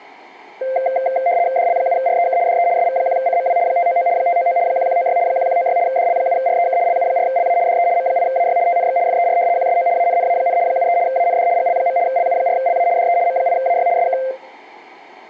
RTTY (75 baud, 170 Hz shift), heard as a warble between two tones, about 610 Hz centre, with room echo. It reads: DL7REK DE SV1CMW 599 599 1196 1196 DL7REK LU4LA DE M8AY TNX FER QSO ANNA, 73 AND GL. LU4LA DE M8AY SK